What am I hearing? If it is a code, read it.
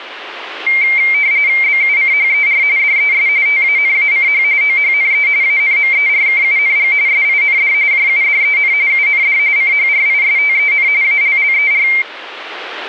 RTTY (45.45 baud, 170 Hz shift), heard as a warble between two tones, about 2200 Hz centre. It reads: BUCHER DES TANACH OHNE ANMERKUNG SIND JUDEN UND CHRISTEN ALLER